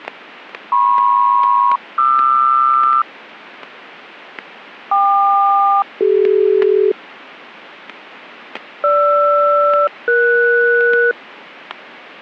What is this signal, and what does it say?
Aircraft SELCAL, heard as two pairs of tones, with static crashes. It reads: MP-QR KQ-CD GR-ES